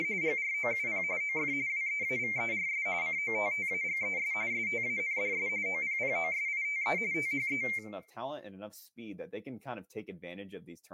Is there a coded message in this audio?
Yes: RTTY (45.45 baud, 170 Hz shift) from 0.0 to 7.8 s, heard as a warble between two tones, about 2200 Hz centre, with room echo and speech in English. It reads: … GROUP OF WEAVERS COTTAGES STANDS OPPOSITE THE